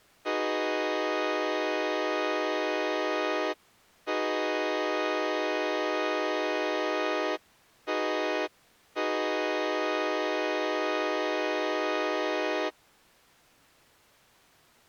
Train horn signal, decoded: 2 long, 1 short, 1 long

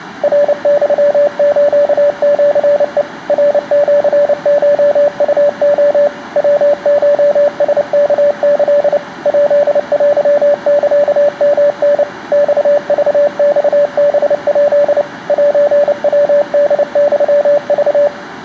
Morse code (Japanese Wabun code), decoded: ナユスシヘ ナシコウレ ヤコラワキ ヱテサヨタ マクマハヱ セヤホユク

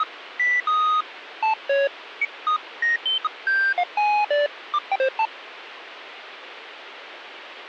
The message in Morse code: none

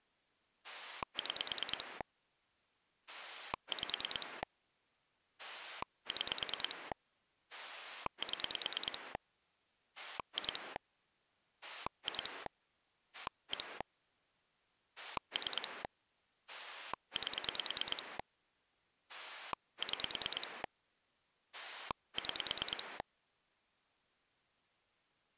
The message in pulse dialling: 6 5 6 7 2 2 1 3 8 6 6

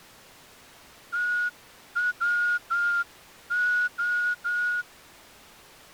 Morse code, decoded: TWO

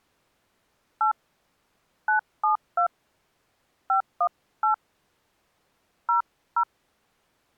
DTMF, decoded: 8 972 518 00

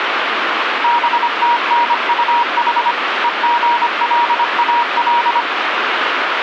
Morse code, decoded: BTNUH EGLAL

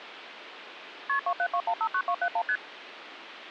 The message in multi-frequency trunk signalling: KP 272159271 ST

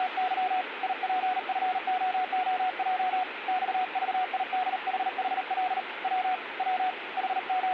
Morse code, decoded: … IPFOOJ XVIDHHL W W …

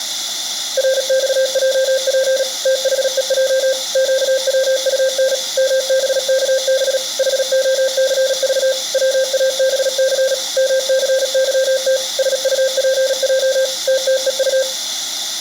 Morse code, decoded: RXJP THEJ QWUN MBKB HOCV WABC MCYT SUPJ TTEU

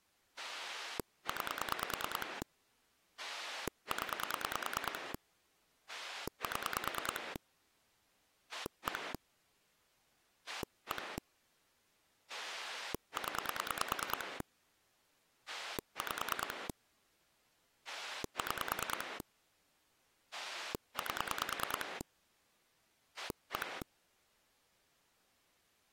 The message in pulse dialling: 9 0 7 1 1 0 5 6 8 1

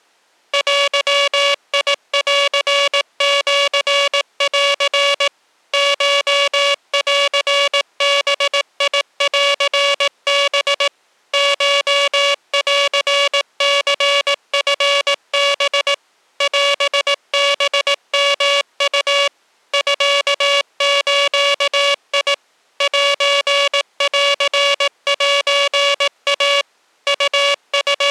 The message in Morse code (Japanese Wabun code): デンシン コンバンハ コンニチハ オハヨウ ミズ センセイ …

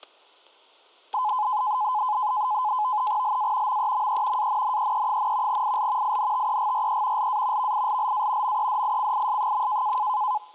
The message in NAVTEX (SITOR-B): LA MEME ANNEE, IL INTEGRE LA VILLA MEDICIS.

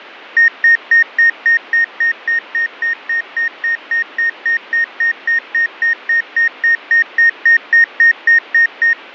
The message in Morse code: none

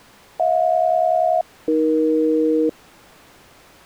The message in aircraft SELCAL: HJ-AE

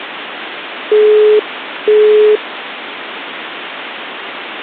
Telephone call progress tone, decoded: busy tone

